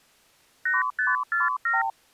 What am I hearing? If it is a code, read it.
Multi-frequency trunk signalling (R2, with the far end's replies), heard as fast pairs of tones, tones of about 170 ms. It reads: 8547